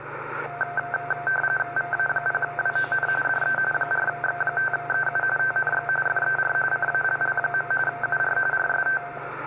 RTTY (45.45 baud, 850 Hz shift), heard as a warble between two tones, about 1130 Hz centre, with radio static and the noise inside a lift. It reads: VA0WON DE 4X5EU TNX FER CALL. UR RST